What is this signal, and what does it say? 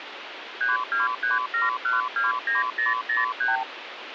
Multi-frequency trunk signalling (R2, with the far end's replies), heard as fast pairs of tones, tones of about 160 ms, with phone line noise. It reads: 3237129003